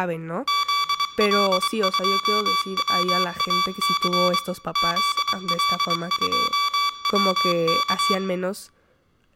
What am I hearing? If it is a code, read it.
Morse code, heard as electronic beeps, machine-sent, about 23 wpm, 1150 Hz, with room echo and speech in Spanish. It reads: ZL2WAC ZL2WK